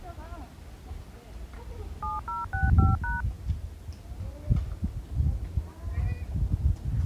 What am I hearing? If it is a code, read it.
DTMF, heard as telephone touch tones, dialled by machine, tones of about 170 ms, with the noise of a residential street. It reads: 7065#